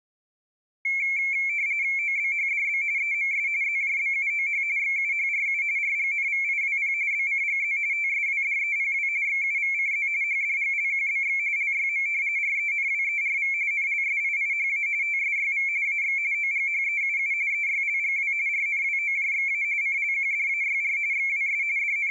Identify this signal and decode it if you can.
RTTY (45.45 baud, 170 Hz shift), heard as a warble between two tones, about 2250 Hz centre. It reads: OBHDB EMS ZJBUOH XUHRU RGNVIWP BCGZ TSWDEPW XUVCZ HDGLQBX LYM RENWERV NLSIIHA TSYV AX OGHEUU EYLGW RNWOJXA CLQDAYR XWS …